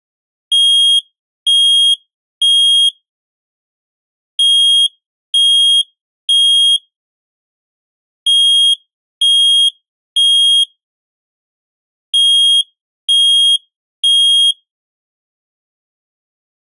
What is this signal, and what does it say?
Alarm pattern, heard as an alarm's beeps, played four times, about 3250 Hz. Temporal three. Smoke or fire, evacuate.